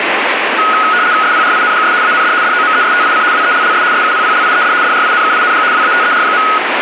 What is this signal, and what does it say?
RTTY (75 baud, 170 Hz shift), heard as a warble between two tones, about 1360 Hz centre, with radio static. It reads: SPRINGS AND DOMESTIC WELLS SUPPLIED DRINKING WATER.